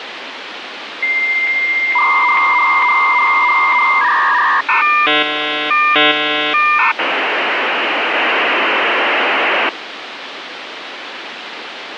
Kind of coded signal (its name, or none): dial-up modem handshake